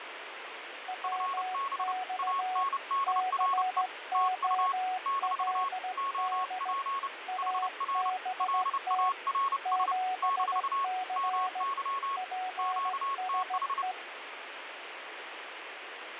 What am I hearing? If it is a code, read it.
Morse code, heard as two keyed tones, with radio static. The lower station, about 16 wpm, 740 Hz: WX COLD ABT 7C PSE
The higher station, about 30 wpm, 1100 Hz: FB ANDRE TU - OP HR LARS - MY QTH